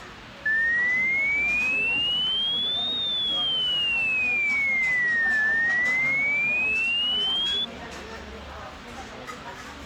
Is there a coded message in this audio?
No, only a tone that sweeps in pitch again and again, with phone line noise and the noise of a restaurant.